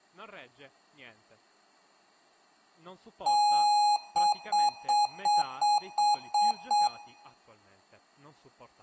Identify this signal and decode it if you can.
Beep code, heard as beeps from a small speaker, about 830 Hz, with room echo and speech in Italian. 1 long, 8 short. In AMI BIOS tables: display or retrace test failure.